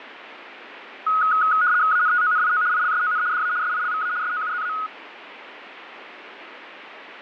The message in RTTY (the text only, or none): ANTONIO ILSON DA SILVA SOUZA